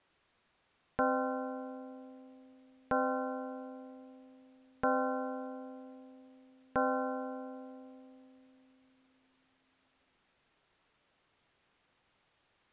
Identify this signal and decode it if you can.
Clock strike, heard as a bell. 4. Four o'clock.